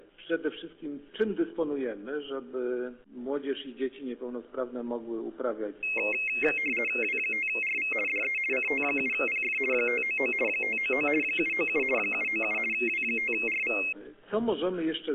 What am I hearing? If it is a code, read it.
RTTY (50 baud, 450 Hz shift), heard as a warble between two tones, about 2350 Hz centre. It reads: W5RV DE CT7PF 599 599 797 797 W5RV